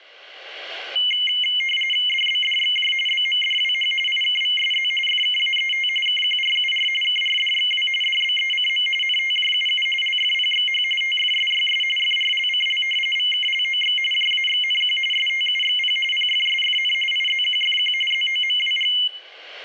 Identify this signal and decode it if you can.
RTTY (45.45 baud, 850 Hz shift), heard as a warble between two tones, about 2550 Hz centre, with room echo. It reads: DBDXJ BMDWH IKVSZ FKAET KQRUR KRDXW DBECM NTJUU LFPXH TFSYS FRLCL VKLOX JAXNQ STUXP PFSFN IZQFQ ZOMWG